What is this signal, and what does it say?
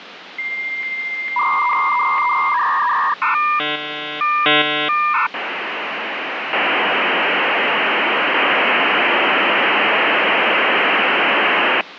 Dial-up modem handshake (V.34 or later), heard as a whistle, warbles, then hiss, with phone line noise.